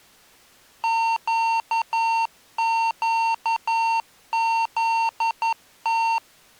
Morse code, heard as electronic beeps, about 11 wpm, 910 Hz. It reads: QQZT